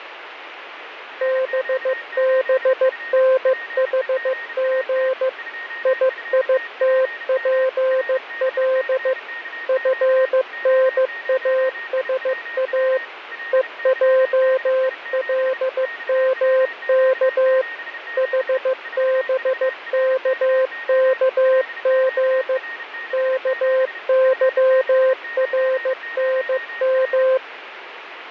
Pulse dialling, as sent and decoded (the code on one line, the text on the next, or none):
none